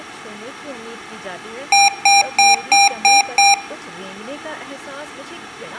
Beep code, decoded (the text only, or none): 6 short